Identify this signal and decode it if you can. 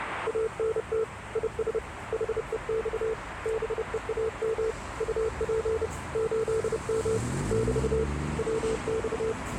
Morse code, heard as a keyed tone, hand-sent with a paddle, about 30 wpm, 440 Hz, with radio static and street noise. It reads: ANT IS HEX BEAM UP 8M <BT> WX